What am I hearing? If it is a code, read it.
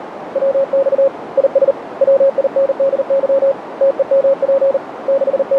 Morse code, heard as a keyed tone, hand-sent with a paddle, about 39 wpm, 550 Hz, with radio static and a narrow filter. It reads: WX IS WINDY TEMP …